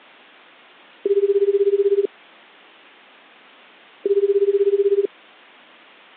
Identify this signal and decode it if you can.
Telephone call progress tone (Japanese plan), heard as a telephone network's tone, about 380, 400, 420 Hz, 1 s on and 2 s off. Ringback tone.